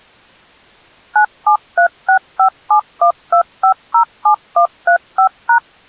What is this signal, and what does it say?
DTMF, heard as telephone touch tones, dialled by machine, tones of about 90 ms. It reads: 97365712507135#